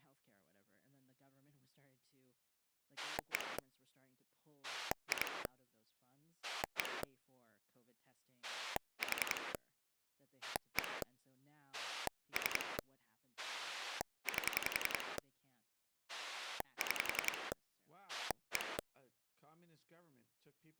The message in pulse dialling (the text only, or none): 1 2 1 4 1 3 8 6 1